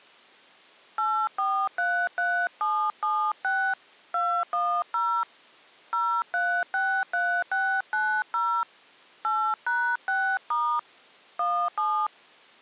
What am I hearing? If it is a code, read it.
DTMF, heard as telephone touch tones, dialled by hand, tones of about 290 ms. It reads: 8433776 210 0363690 8#6* 17